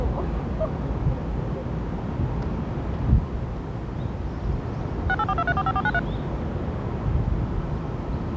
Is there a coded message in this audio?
Yes: DTMF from 5.1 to 6.0 s, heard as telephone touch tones, dialled by machine, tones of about 50 ms, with the noise of a park. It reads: 6842345493